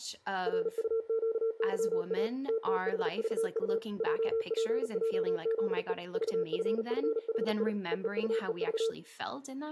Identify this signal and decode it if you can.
Morse code, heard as a keyed tone, machine-sent, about 38 wpm, 450 Hz, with room echo and speech in English. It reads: RUQYA TTHVU JPJZE VFFHI EEUEV